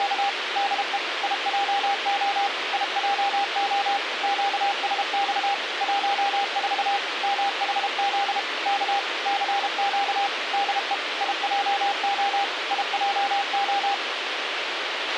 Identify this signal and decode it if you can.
Morse code, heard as a keyed tone, machine-sent, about 32 wpm, 800 Hz, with radio hiss and a squelch burst at the end. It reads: … DE IJO IJO QSX 14 MHZ K CQ DE IJO IJO